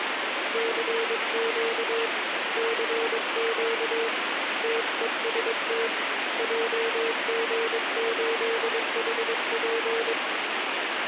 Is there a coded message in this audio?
Yes: Morse code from 0.5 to 10.2 s, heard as a keyed tone, hand-sent with a paddle, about 22 wpm, 460 Hz, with heavy radio static. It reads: CQ CQ TEST JG8HP